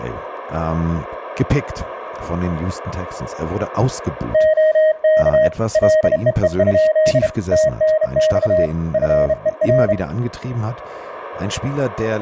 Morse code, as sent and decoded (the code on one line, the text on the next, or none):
--- -.- / .-.. . . ..--.. / - -. -..- / ..-. . .-.
OK LEE? TNX FER